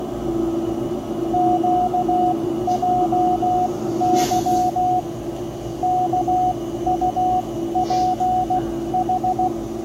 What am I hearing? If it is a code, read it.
Morse code, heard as a keyed tone, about 16 wpm, spaced as for 13 wpm, 730 Hz, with the noise inside a bus. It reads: QJY KUPH